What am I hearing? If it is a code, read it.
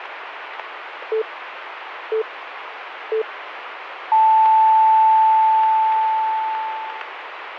Radio time signal (three low pips and a long one an octave up, as on NHK), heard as pips, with radio static.